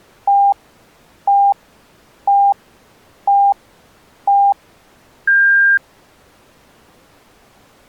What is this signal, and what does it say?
Radio time signal (five pips and a higher one, as on Chinese radio), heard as pips.